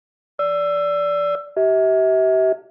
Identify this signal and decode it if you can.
Aircraft SELCAL, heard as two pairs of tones, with room echo. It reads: GR-CH